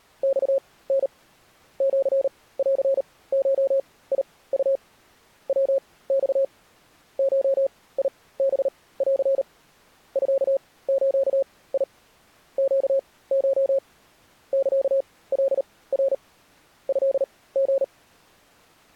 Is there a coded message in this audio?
Yes: Morse code (Japanese Wabun code) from 0.2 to 17.9 s, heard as a keyed tone, machine-sent, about 38 wpm, spaced as for 20 wpm, 540 Hz. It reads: マタ シンゴウ ヤマ ゴハン ミズ ネコ サカナ トリ